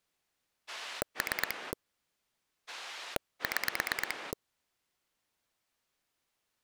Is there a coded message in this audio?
Yes: pulse dialling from 0.7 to 4.3 s, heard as a rotary dial, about 8 pulses a second. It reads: 3 6